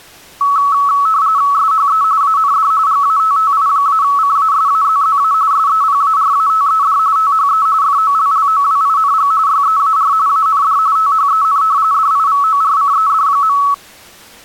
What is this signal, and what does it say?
RTTY (45.45 baud, 170 Hz shift), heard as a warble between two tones, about 1210 Hz centre. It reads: SHE AND GATTI-CASAZZA SEPARATED THE FOLLOWING YEAR AND THEN DIVORCED.